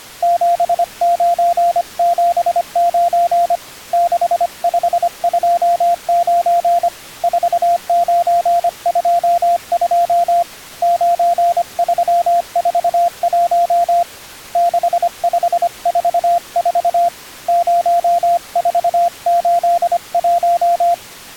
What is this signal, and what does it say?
Morse code, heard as a keyed tone, hand-sent with a paddle, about 25 wpm, 690 Hz. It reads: 7979 6529 4922 9341 6544 0481